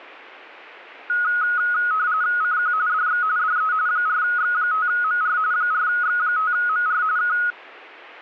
RTTY (45.45 baud, 170 Hz shift), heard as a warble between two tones, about 1360 Hz centre. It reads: CQ DX DE 4X5MR 4X5MR K